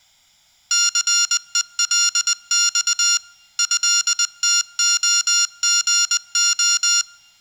Morse code (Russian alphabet), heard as electronic beeps, machine-sent, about 20 wpm, 1400 Hz. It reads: ЦЕЛЬ ЭТОГО